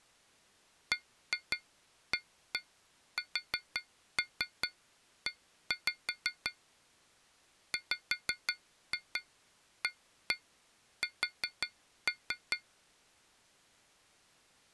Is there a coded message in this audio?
Yes: tap code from 0.9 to 12.7 s, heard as taps on glass, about 5 knocks a second. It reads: BASE WAS